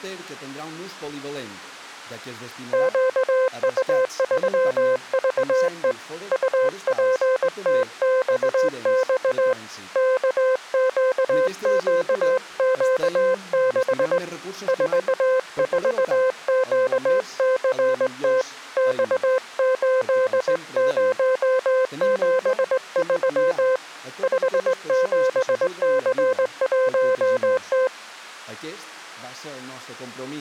Morse code, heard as a keyed tone, hand-sent with a straight key, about 19 wpm, 520 Hz. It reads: QU3VE UPTXX KQQQ6 44QCT X8073 57C1T